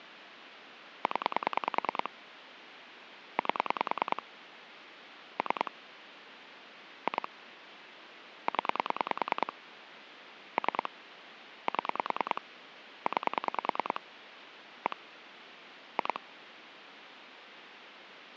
Pulse dialling, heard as clicks on a phone line, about 10 pulses a second, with phone line noise. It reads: 0 8 3 2 0 3 7 9 1 2